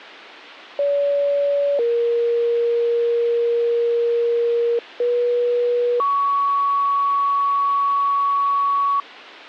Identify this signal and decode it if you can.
Two-tone page, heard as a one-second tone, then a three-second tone, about 570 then 470 Hz, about 480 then 1120 Hz.